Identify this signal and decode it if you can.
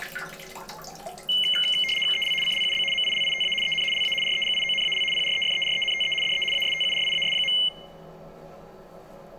RTTY (75 baud, 850 Hz shift), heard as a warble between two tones, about 2550 Hz centre, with the noise of a restroom. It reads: EL CLUB MILITA EN LA REGIONAL PREFERENTE DE ASTURIAS.